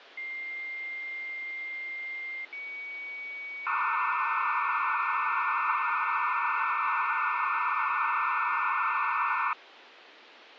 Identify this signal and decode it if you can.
Dial-up modem handshake (low-speed, two carriers), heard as two whistles, then hiss, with phone line noise.